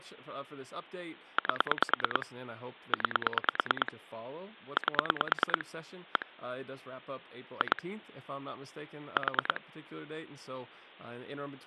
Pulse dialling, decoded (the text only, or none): 8 9 8 1 2 4